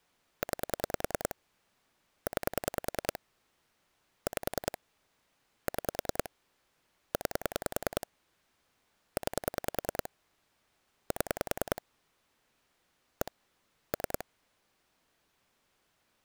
Pulse dialling, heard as clicks on a phone line, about 10 pulses a second. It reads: 9 9 5 6 9 9 7 1 3